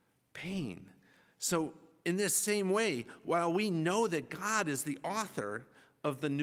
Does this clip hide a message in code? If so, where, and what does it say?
No, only speech in English.